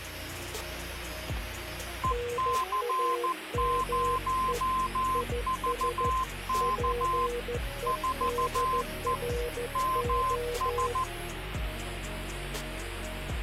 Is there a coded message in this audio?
Yes: Morse code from 2.0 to 11.1 s, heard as two keyed tones, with radio static. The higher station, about 14 wpm, 1040 Hz: EC0VK 4E MS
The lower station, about 14 wpm, 480 Hz: NAME IS PEDRO